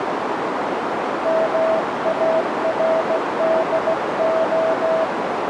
Morse code, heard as a keyed tone, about 16 wpm, 650 Hz, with heavy radio static and a narrow filter. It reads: MARDO